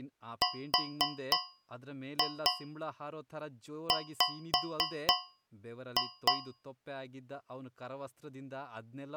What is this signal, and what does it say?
Tap code, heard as taps on a metal pipe, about 3 knocks a second, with speech in Kannada. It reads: RW